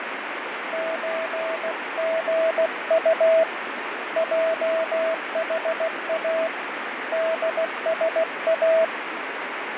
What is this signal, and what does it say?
Morse code (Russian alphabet), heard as a keyed tone, hand-sent with a paddle, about 16 wpm, 650 Hz, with radio static and fading. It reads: ЧГУ ЙХА ДСА